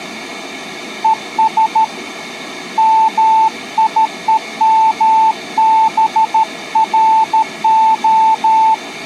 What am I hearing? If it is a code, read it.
Morse code, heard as a keyed tone, hand-sent with a paddle, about 13 wpm, 880 Hz. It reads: ES MIEMBRO